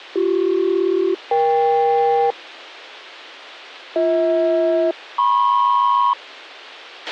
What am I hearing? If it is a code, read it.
Aircraft SELCAL, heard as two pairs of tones, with a squelch burst at the end. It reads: BC-EK BH-MP